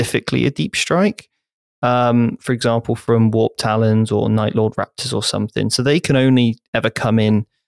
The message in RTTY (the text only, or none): none